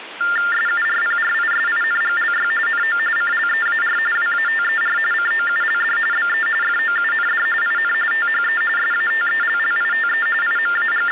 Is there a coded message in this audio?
Yes: TTY/TDD text telephone tones (45.45 baud Baudot) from 0.2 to 11.1 s, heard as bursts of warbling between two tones, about 400 Hz shift, 1600 Hz centre, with phone line noise. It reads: SURPRISINGLY NO CLEAR WATER COULD BE FOUND IN THE SATELLITE …